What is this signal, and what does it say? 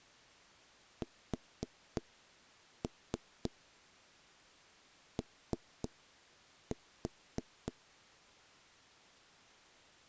Tap code, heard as knocks on wood, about 3 knocks a second. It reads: SO